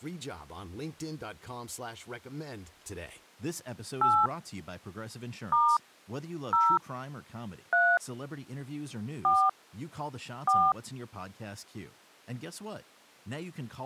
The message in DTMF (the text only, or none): 8 * 0 3 4 4